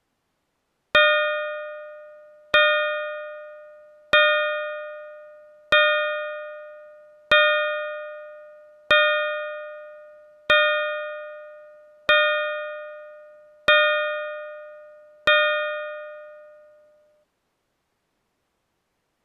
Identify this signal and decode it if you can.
Clock strike, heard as a bell. 10. Ten o'clock.